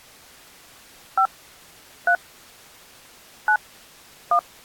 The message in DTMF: 5 3 9 1

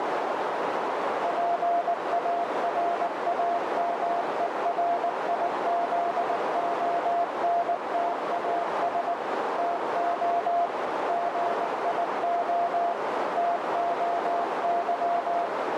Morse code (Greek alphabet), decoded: ΠΑΡΑΜΕΡΙΖΟΝΤΑΣ ΤΟ ΓΙΟ ΤΟΥ

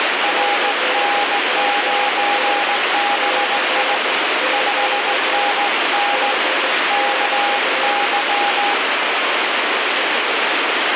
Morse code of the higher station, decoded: RN9BI 5NN KY

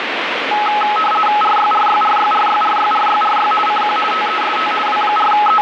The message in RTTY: RYRYRYRYRYRYRY CQ TEST …

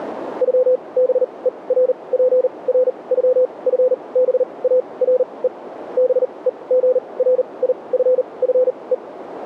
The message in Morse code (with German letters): ÜBERPRÜFBARE BEGRIFFE

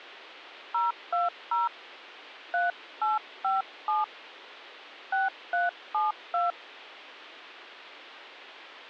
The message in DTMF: 020 3857 6372

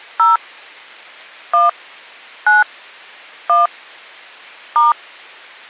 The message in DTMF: 0 1 9 1 *

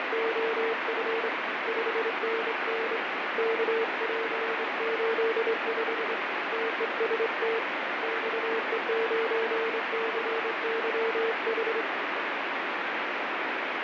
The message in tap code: none

